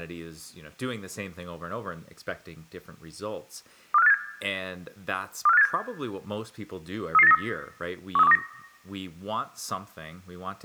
Five-tone selective call (EEA), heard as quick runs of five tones, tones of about 40 ms, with room echo and speech in English. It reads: 24587 24587 33893 13129